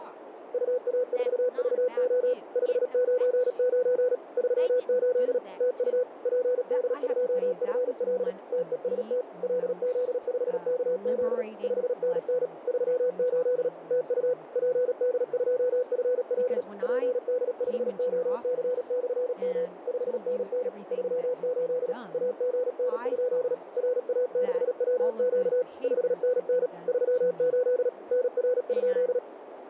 Morse code, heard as a keyed tone, machine-sent, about 37 wpm, 500 Hz, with radio static, a narrow filter and speech in English. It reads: UA4VO 599 38 TU PD2FL TEST LZ5KZ 5NN 38 TU PD2FL PD5OC/M 5NN 38 AGN? RA6WQ 5NN 38 NR?